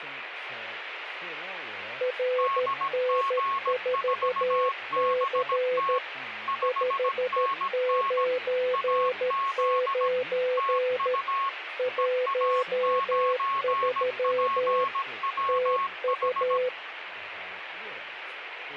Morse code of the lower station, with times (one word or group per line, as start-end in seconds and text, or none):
2.0-6.0 RN4C
6.6-11.1 599
11.8-14.8 13
15.5-16.7 TU